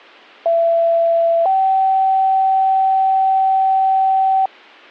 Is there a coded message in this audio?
Yes: two-tone page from 0.5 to 4.5 s, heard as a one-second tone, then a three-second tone, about 670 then 770 Hz.